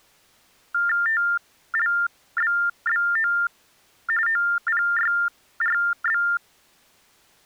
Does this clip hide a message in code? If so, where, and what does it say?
Yes: TTY/TDD text telephone tones (45.45 baud Baudot) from 0.7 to 6.4 s, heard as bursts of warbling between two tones, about 400 Hz shift, 1600 Hz centre. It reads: TLBBO OPYRB